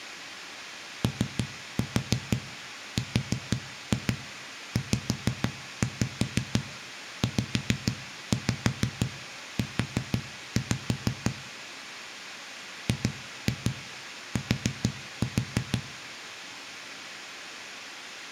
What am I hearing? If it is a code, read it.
Tap code, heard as knocks on a wall, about 6 knocks a second, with room echo. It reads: ORZZU GT